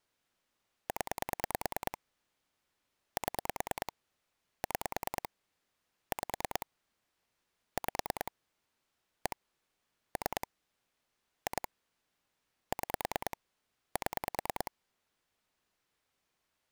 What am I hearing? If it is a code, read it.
Pulse dialling, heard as clicks on a phone line, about 9 pulses a second. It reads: 0 7 6 5 5 1 3 2 6 7